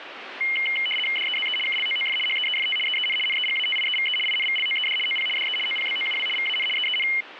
RTTY (75 baud, 850 Hz shift), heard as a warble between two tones, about 2550 Hz centre, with radio static. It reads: DEZE KLOOF HEEFT EEN NEGATIEVE INVLOED OP DE OPBOUW VAN EEN